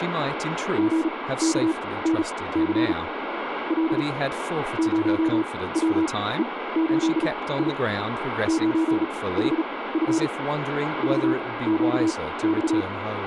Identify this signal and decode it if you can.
Morse code, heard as a keyed tone, machine-sent, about 36 wpm, spaced as for 19 wpm, 320 Hz, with radio static and speech in English. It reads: GKNC L 0WE8I 9HF VQX